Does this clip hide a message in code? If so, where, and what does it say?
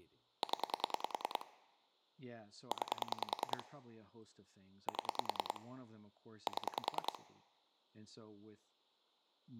Yes: pulse dialling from 0.4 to 7.2 s, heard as clicks on a phone line, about 10 pulses a second, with speech in English. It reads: 0 9 7 7